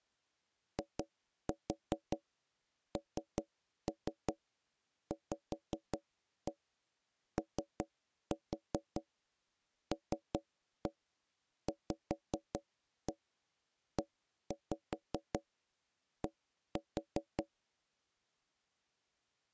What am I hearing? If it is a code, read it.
Tap code, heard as knocks on wood, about 5 knocks a second. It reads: INVOLVED